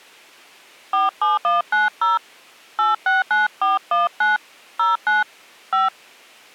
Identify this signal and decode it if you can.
DTMF, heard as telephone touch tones, dialled by hand, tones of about 160 ms. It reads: 47190 869419 09 5